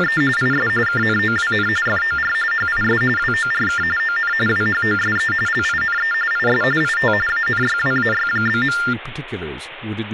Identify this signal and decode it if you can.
TTY/TDD text telephone tones (45.45 baud Baudot), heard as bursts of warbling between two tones, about 400 Hz shift, 1600 Hz centre, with phone line noise and speech in English. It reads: … IS KNOWN FOR HIS WORK ON WHOSE LINE IS IT ANYWAY?.